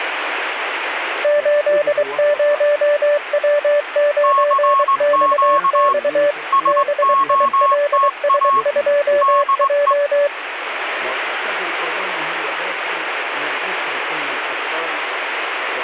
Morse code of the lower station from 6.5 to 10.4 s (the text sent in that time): BILS2J